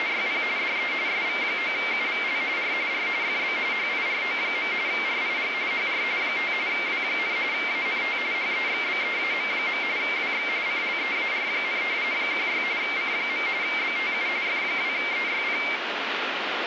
RTTY (45.45 baud, 170 Hz shift), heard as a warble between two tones, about 2200 Hz centre, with radio static. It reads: … DE SV9UVL R R FB HIRO. RIG HR 5 W, ANT HEXBEAM. WX CLEAR, 16 C. BTU F2EYP